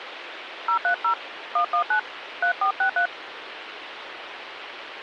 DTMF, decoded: 030 119 3463

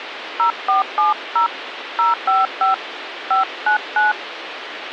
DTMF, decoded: 0470 055 599

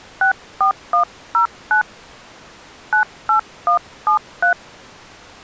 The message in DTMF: 64109 98173

